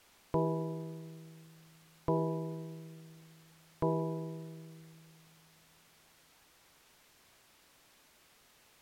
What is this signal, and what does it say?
Clock strike, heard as a bell. 3. Three o'clock.